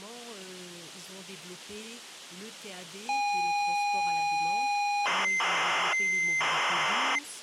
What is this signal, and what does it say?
ZX Spectrum tape loading, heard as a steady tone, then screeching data.